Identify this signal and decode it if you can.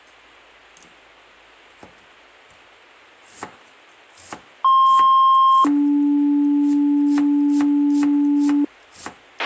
Two-tone page, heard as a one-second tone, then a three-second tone, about 1060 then 290 Hz, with a squelch burst at the end and kitchen noise.